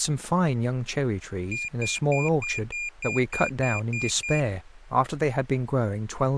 Beep code, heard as a piezo beeper, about 2400 Hz, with speech in English. 10 short. In AMI BIOS tables: CMOS shutdown register error.